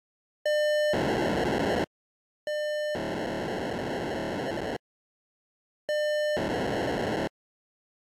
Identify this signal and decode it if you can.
POCSAG pager data (1200 baud), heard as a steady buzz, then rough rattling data.